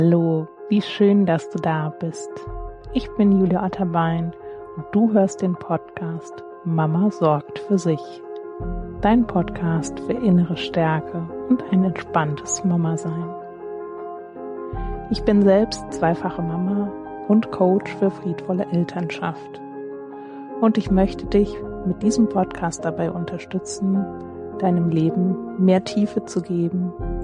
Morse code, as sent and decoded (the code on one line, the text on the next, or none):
none